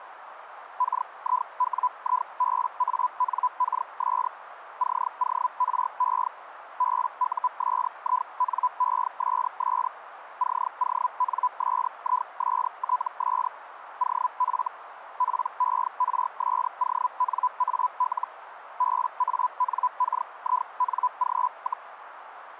Hellschreiber (Feld-Hell, 122.5 baud), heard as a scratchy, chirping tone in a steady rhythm, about 1000 Hz, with radio static and a narrow filter. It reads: KIWIBANKS CORE BUSINESS CONSISTS OF PERSONAL BANKING,